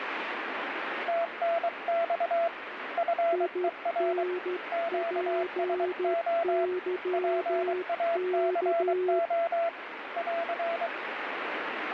Morse code, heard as two keyed tones, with radio static. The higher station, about 23 wpm, 680 Hz: TNX FER QSO PACO <AR>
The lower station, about 12 wpm, 360 Hz: INPYK